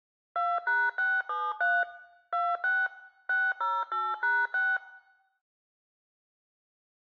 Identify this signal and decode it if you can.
DTMF, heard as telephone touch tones, dialled by machine, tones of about 220 ms, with room echo. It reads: 2#673 26 608#6